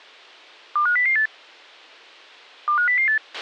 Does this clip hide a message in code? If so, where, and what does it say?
Yes: five-tone selective call (CCIR) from 0.8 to 3.2 s, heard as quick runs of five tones, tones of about 100 ms, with a squelch burst at the end. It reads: 25008 25008